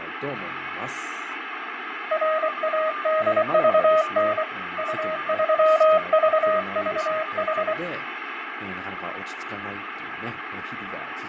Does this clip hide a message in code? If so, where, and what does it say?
Yes: Morse code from 2.1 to 7.8 s, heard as a keyed tone, hand-sent with a paddle, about 24 wpm, 630 Hz, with radio static, fading, a weaker station near 1200 Hz and speech in Japanese. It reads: RADVN U3VVH